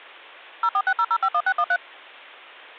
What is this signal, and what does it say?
DTMF, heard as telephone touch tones, dialled by machine, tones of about 60 ms. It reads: 0460051613